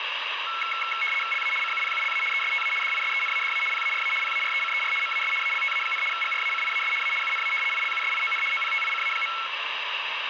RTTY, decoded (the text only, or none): LA CUPULA ESTA DISENADA PARA PARECER MAS ALTA, GRACIAS A UNA ILUSION OPTICA.